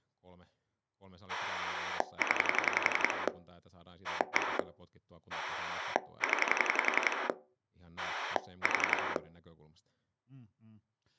Pulse dialling, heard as a rotary dial, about 11 pulses a second, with speech in Finnish. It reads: 0 1 0 4